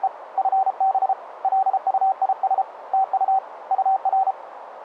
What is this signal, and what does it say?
Morse code, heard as a keyed tone, hand-sent with a paddle, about 33 wpm, 770 Hz, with radio static and a narrow filter. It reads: … FB LUIS TU UR